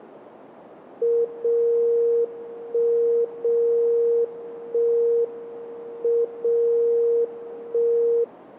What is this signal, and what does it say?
Radio time signal (WWVB), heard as a tone whose level steps once a second, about 470 Hz. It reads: 0 1 0 1 M 0 1